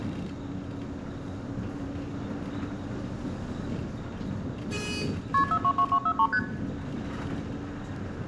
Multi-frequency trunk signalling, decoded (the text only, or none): KP 422243 ST